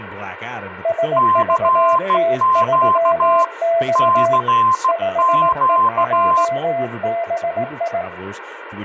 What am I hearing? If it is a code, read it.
Morse code, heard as two keyed tones, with speech in English. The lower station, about 18 wpm, 670 Hz: SVT3X 5EJBI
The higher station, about 16 wpm, 1040 Hz: CQ CQ